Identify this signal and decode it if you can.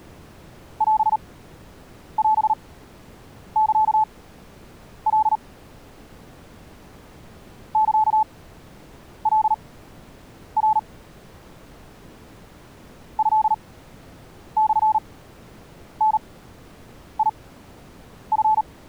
Morse code (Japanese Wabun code), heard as a keyed tone, machine-sent, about 38 wpm, spaced as for 8 wpm, 870 Hz. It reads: オオサカ サカナ トモダチ